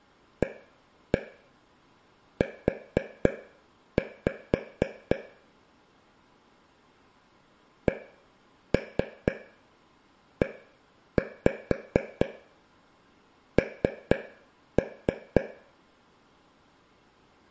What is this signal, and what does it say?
Tap code, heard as taps on a table, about 4 knocks a second, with room echo. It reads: AU CEN